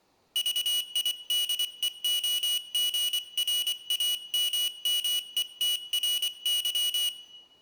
Morse code, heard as a high beeper, hand-sent with a paddle, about 24 wpm, 2900 Hz, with room echo. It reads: VIDEOGRAMMETRY